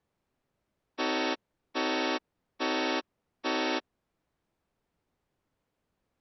Train horn signal, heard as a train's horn. 4 short. On North American railways: a request for a signal to be given or repeated.